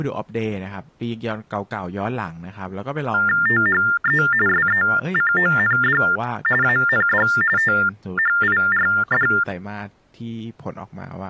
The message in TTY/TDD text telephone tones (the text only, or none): THE SECOND AND THIRD